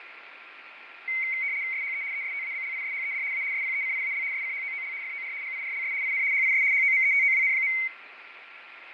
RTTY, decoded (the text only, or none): SHE ESTABLISHED A SPECIAL SCHOOL FOR GIRLS IN HIS HOMETOWN.